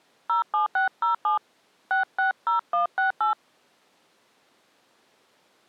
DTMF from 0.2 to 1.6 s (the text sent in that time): 07607